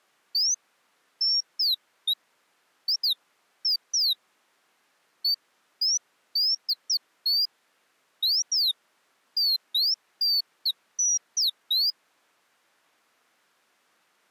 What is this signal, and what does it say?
Bird-like chirps. There is no code.